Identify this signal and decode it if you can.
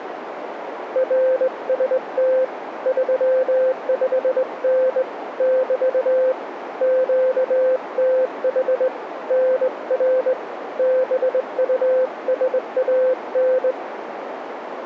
Morse code, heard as a keyed tone, hand-sent with a straight key, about 20 wpm, 520 Hz, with radio static and a narrow filter. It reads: RST 35N <BT> QTH NR BUSAN